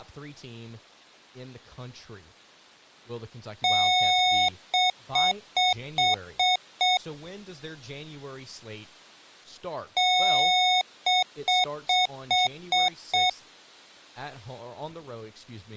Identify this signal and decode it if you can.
Beep code, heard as beeps from a small speaker, played twice, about 730 Hz, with speech in English. 1 long, 6 short.